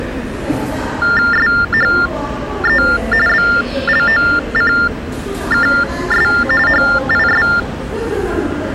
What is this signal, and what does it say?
TTY/TDD text telephone tones (45.45 baud Baudot), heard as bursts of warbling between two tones, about 400 Hz shift, 1600 Hz centre, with the noise of a subway station. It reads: SHE BLOCKS HIS